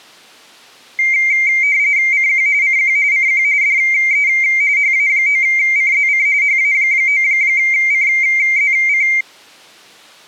RTTY (45.45 baud, 170 Hz shift), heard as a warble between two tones, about 2200 Hz centre. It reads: CQ CQ CQ DE HA9CZC HA9CZC